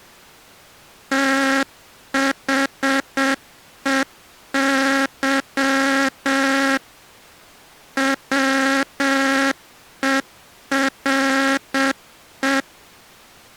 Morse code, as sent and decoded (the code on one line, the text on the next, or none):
- .... . -.-- / .-- . .-. .
THEY WERE